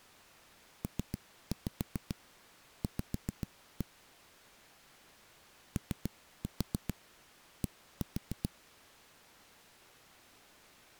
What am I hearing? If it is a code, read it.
Tap code, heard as knocks on a wall, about 7 knocks a second. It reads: PV OD